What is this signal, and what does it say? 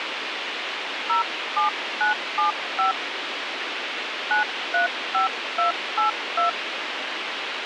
DTMF, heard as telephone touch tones, dialled by hand, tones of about 130 ms, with radio hiss. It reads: 07975 935282